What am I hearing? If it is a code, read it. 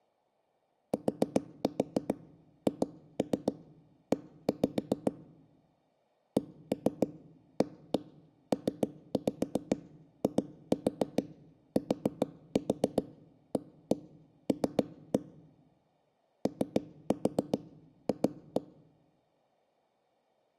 Tap code, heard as knocks on a wall, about 7 knocks a second. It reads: THE CAPITAL OF